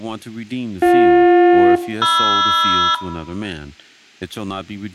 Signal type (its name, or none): aircraft SELCAL